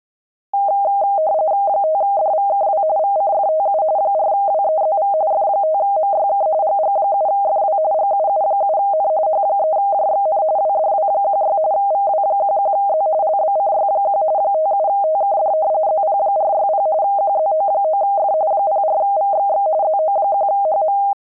RTTY (45.45 baud, 170 Hz shift), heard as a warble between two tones, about 710 Hz centre. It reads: 5DVKW VCFTU 4WEZV F5MYK GG7FW GUU7N H3JXN WDW16 VW11Z LBCY1 57TKD ZP460 QZO9F 04VXX ZO1HM